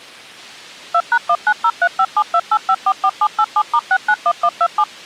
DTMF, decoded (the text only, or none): 2#19035728544787*691127